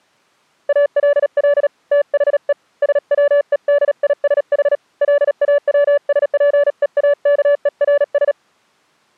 Morse code, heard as a keyed tone, hand-sent with a paddle, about 37 wpm, 580 Hz. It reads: ALL THE SWEDISH LAWSPEAKERS